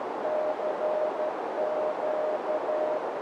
Morse code, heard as a keyed tone, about 12 wpm, 610 Hz, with heavy radio static and a narrow filter. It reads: CQ